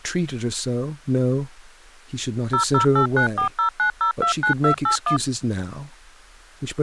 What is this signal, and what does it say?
DTMF, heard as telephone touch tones, dialled by machine, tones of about 100 ms, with speech in English. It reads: 0089409029281